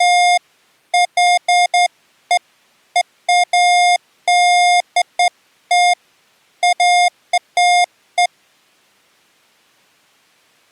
Beeps of irregular length. There is no code.